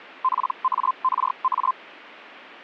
Hellschreiber (Feld-Hell, 122.5 baud), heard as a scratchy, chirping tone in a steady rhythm, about 1040 Hz. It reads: PARA